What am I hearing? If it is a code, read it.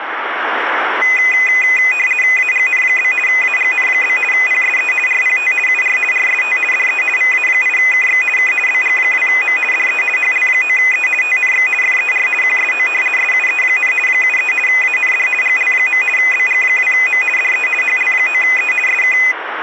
RTTY (50 baud, 450 Hz shift), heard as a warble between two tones, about 2250 Hz centre, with radio static. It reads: AGN? AGN? PSE RPT UR RST DE VA8KX K BG2M DE HL9E TNX FER QSO SUE, 73 AND GL. BG2M DE HL9E SK